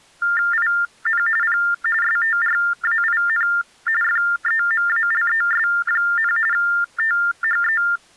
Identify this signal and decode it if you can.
TTY/TDD text telephone tones (45.45 baud Baudot), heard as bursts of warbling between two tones, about 400 Hz shift, 1600 Hz centre. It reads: IN P STRAIN FEMALES, THE